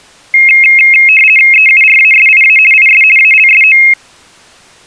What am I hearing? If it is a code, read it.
RTTY (50 baud, 450 Hz shift), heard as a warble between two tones, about 2350 Hz centre. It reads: EURASIA IS ALSO